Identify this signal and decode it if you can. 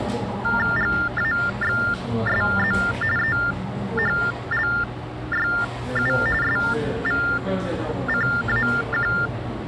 TTY/TDD text telephone tones (45.45 baud Baudot), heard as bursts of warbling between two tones, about 400 Hz shift, 1600 Hz centre, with the noise of a cafe. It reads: GAXSZ EHLYU SVCAQ